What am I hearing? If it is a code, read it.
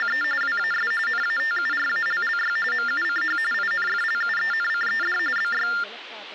TTY/TDD text telephone tones (45.45 baud Baudot), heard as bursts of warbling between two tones, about 400 Hz shift, 1600 Hz centre, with phone line noise and speech in Sanskrit. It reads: … WAS NATURALLY MUCH INFLUENCED BY